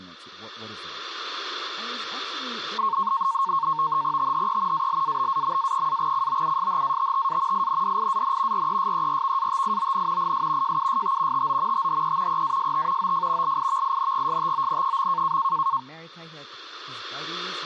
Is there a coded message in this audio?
Yes: NAVTEX (SITOR-B), 100 baud, 170 Hz shift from 2.8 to 15.8 s, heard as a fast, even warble, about 1000 Hz centre, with speech in English. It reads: THE ALABAMA-COUSHATTA INDIAN RESERVATION IS JUST TO THE EAST OF LIVINGSTON.